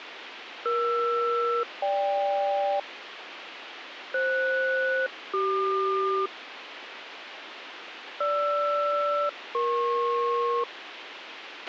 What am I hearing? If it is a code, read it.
Aircraft SELCAL, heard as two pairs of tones, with radio hiss and a squelch burst at the end. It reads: ER-GK FS-CQ GR-EP